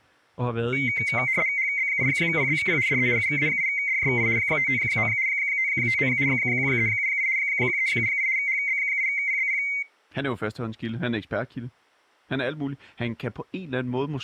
RTTY (75 baud, 170 Hz shift), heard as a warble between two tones, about 2150 Hz centre, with speech in Danish. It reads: HB8PBP DE UA8DJI 559 559 1378 1378 HB8PBP